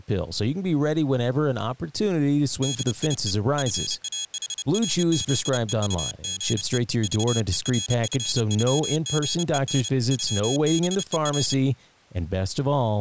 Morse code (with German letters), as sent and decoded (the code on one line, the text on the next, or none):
-.. .. . / ..-. .- .... .-. --.. . ..- --. . / ...- . .-. ..-. ..-- --. . -. / ..-- -... . .-.
DIE FAHRZEUGE VERFÜGEN ÜBER